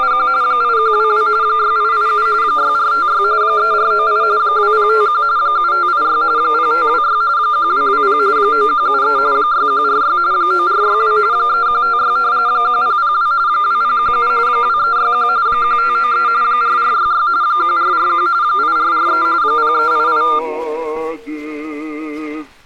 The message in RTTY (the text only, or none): … 8122 6887 6456 3498 2051 7586 0526 1220 9173 6146 9462 3156 1002 2017 2361 1593 4466 1441 8443 0388